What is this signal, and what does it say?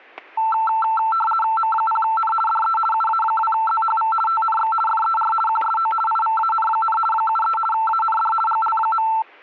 RTTY (50 baud, 450 Hz shift), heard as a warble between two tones, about 1110 Hz centre, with static crashes. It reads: M0N DE UA2ZHV TNX FER QSO IVAN, 73 AND GL.